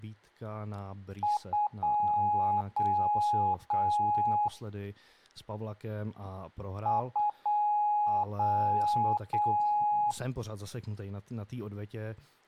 Beep code, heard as beeps, played twice, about 840 Hz, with speech in Czech. 2 short, 3 long.